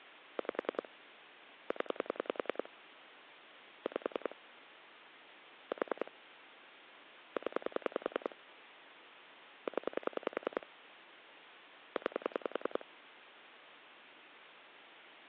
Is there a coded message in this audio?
Yes: pulse dialling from 0.4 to 12.8 s, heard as clicks on a phone line, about 10 pulses a second. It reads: 5 0 5 4 0 0 9